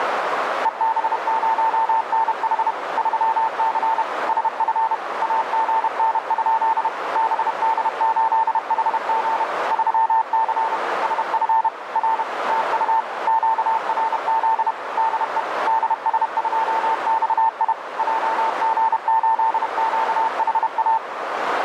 Morse code, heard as a keyed tone, machine-sent, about 31 wpm, 900 Hz, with heavy radio static and a narrow filter. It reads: EB0NH 3C SF AGN? BD8HG 3C SF R TU QRZ DE DS2XI JG8QHA